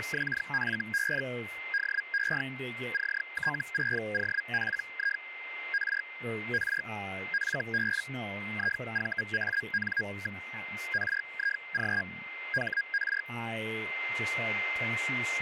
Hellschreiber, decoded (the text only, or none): … DE CT6OPI R R FB IVAN. RIG HR